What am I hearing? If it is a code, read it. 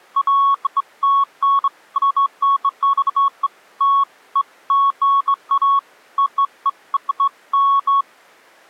Beeps of irregular length. There is no code.